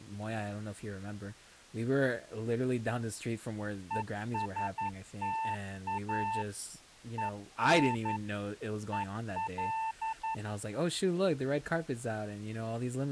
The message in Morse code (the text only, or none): ESTA EN EL